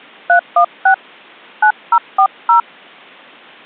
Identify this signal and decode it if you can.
DTMF, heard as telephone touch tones, dialled by hand, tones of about 80 ms. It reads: 316 9040